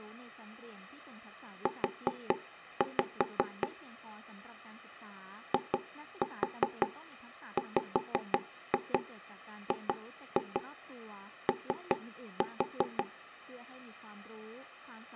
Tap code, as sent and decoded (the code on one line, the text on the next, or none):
4-5 / 2-4 5-2 2-2 3-4
U IWGO